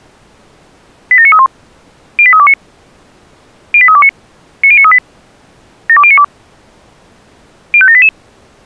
Five-tone selective call (ZVEI), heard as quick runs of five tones, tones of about 70 ms. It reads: 87931 08329 08329 90938 72092 05788